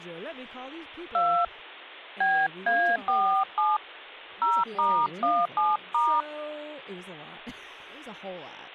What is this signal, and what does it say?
DTMF, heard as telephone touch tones, dialled by hand, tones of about 280 ms, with speech in English. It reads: 2 BA47 0*17*